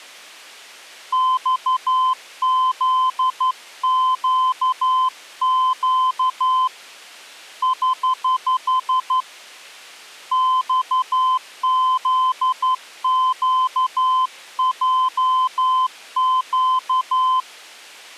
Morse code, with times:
1.1-6.7 XZQQ
7.6-9.2 <HH>
10.3-17.4 XZQJQ

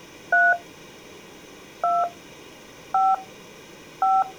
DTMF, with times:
0.3-0.5 3
1.8-2.0 2
2.9-3.1 5
4.0-4.2 5

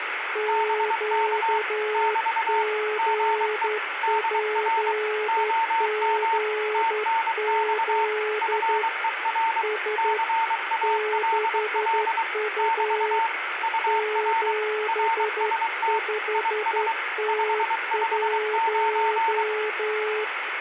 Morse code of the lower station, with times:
0.4-8.8 QGPGZ
9.6-10.2 S
10.8-13.2 6U
13.9-20.2 75T1

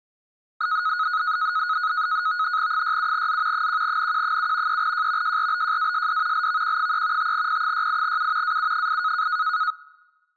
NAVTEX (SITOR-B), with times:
2.7-3.7 67Z
3.5-4.8 1NQ7
4.7-5.4 3J
5.2-6.5 JRBJASD
6.3-7.3 LVQ3
7.2-8.6 5P68U
8.4-9.3 AU8

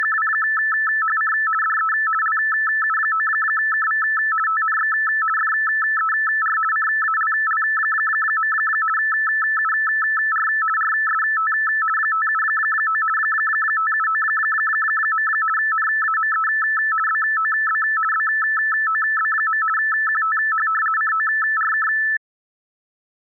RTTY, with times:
0.0-1.3 …
1.6-1.9 DE
2.2-4.0 LU9KV
4.5-4.9 TNX
5.4-6.6 FER
6.7-8.5 CALL.
9.0-10.5 UR
10.8-11.5 RST
12.0-13.0 579
13.2-15.3 579.
15.6-16.5 NAME
17.1-17.8 BOB
18.1-19.6 BOB.
19.8-20.7 QTH
21.0-21.9 CORK

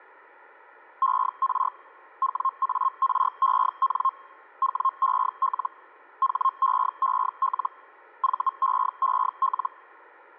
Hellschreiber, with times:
1.0-1.7 ER
2.2-4.1 WAREN
4.6-5.7 WEL
6.2-7.7 HEEL
8.2-9.7 VEEL

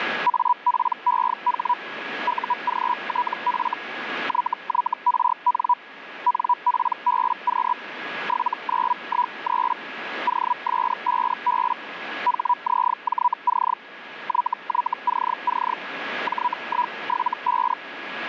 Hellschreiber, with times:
0.3-1.7 APEH
2.3-3.7 UGTF
4.3-5.7 YYRN
6.3-7.7 NPBQ
8.3-9.7 7913
10.3-11.7 OS5B
12.3-13.7 HZJC
14.3-15.7 YYCC
16.3-17.7 J175

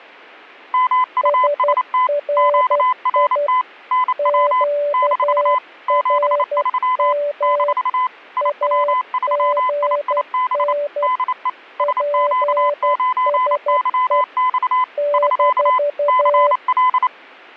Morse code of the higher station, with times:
0.7-2.1 MUST
2.4-3.6 QRT
3.9-4.6 NW
4.9-5.6 -
5.9-7.1 73
7.4-8.1 -
8.4-10.7 IW3IIB
11.0-11.5 DE
11.8-14.8 SQ9YX
15.1-15.8 <SK>
16.1-17.1 CL

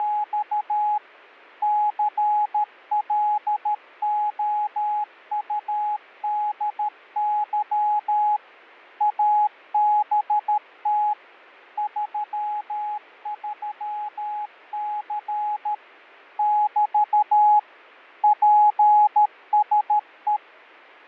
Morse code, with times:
0.0-1.0 …
1.6-8.4 CLOUDY
9.0-11.1 ABT
11.8-15.7 33C
16.4-17.6 <BT>
18.2-20.4 PSE

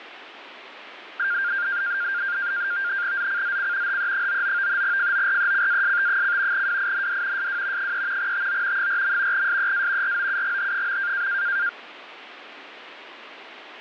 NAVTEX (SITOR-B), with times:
3.2-4.0 ZCZC
3.9-4.8 HE99
4.8-6.7 FORECAST:
6.5-7.5 WIND
7.4-7.9 SW
7.8-8.3 3
8.2-8.9 TO
8.8-9.5 4.
9.3-10.2 SEA
10.0-11.3 ROUGH.

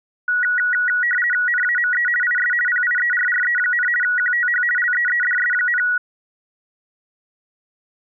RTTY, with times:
1.5-2.1 NAME
2.2-2.5 IS
2.7-3.9 PIERRE,
4.0-4.6 QTH
4.8-5.8 LEEDS,

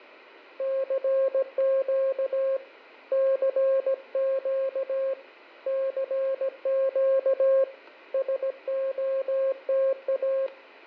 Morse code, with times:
0.6-2.6 CQ
3.1-5.1 CQ
5.7-7.6 CQ
8.1-10.5 SOTA

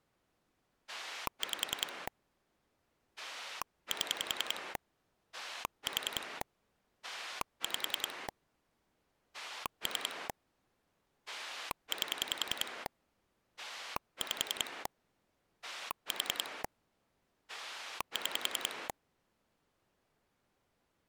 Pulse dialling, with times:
0.9-2.1 5
3.2-4.8 7
5.3-6.4 4
7.0-8.3 5
9.3-10.3 3
11.3-12.9 8
13.6-14.9 5
15.6-16.6 4
17.5-18.9 6

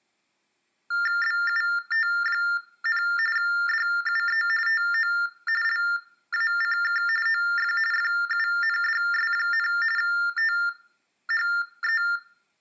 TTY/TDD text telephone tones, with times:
1.2-3.0 BUT,
3.4-4.4 DUE
4.7-5.1 TO
5.6-7.0 LACK
7.3-7.7 OF
7.9-9.7 FUNDS,
10.0-12.0 THE

